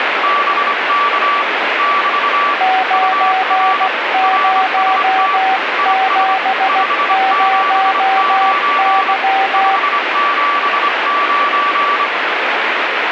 Morse code, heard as two keyed tones, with heavy radio static. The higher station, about 25 wpm, 1160 Hz: BK <BT> UR RST IS 579 579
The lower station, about 16 wpm, 760 Hz: 9070Y